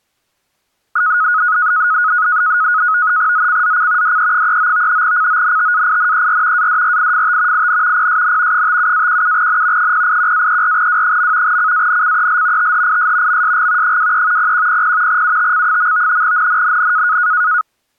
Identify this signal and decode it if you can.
NAVTEX (SITOR-B), 100 baud, 170 Hz shift, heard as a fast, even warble, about 1360 Hz centre. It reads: ZCZC DE39 CONTAINER ADRIFT IN PSN 57-17N 081-34W. CANCEL THIS MSG 23 0100 UTC. NNNN